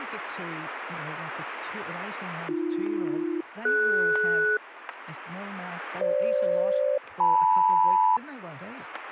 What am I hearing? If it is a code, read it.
Aircraft SELCAL, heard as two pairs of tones, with radio static, static crashes and speech in English. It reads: AB-DS FG-LM